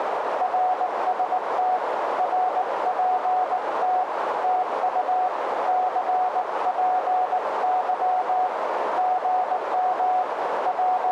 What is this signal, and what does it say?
Morse code, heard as a keyed tone, hand-sent with a bug key, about 19 wpm, 740 Hz, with radio static and a narrow filter. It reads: RST RPT TU CPY GM …